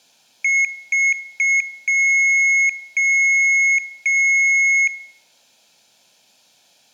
Beep code, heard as beeps, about 2150 Hz, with room echo. 3 short, 3 long.